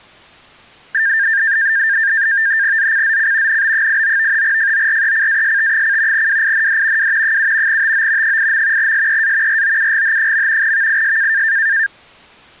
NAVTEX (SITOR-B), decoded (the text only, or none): ZCZC NB89 FORECAST: WIND W 7 TO 8. SEA ROUGH. VIS